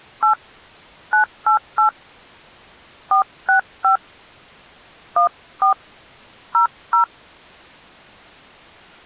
DTMF, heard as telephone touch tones, dialled by hand, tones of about 110 ms. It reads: 8 988 465 14 00